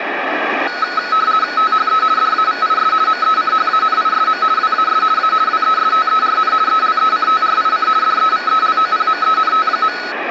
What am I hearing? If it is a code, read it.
RTTY (50 baud, 170 Hz shift), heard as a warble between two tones, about 1380 Hz centre, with radio static. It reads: THE DAVIS MECHANISM WAS A WESTERN ELECTRIC DEVELOPMENT.